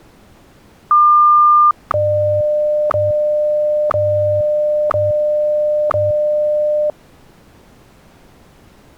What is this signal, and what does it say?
Radio time signal (WWVH, Hawaii), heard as ticks, one a second.